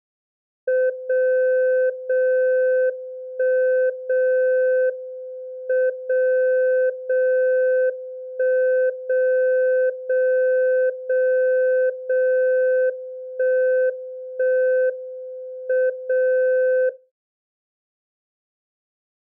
Radio time signal (WWVB), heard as a tone whose level steps once a second, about 510 Hz. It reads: 0 0 1 0 M 0 0 1 0 0 0 0 1 1 M 0